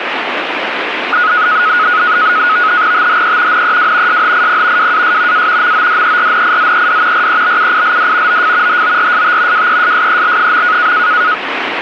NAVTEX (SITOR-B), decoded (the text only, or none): THE NEW SHIP WAS A MODERNIZED REBUILD OF HORST WESSEL.